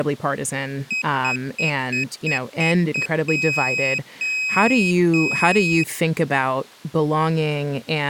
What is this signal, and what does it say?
Beep code, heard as a piezo beeper, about 2550 Hz, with speech in English. 7 short, 3 long.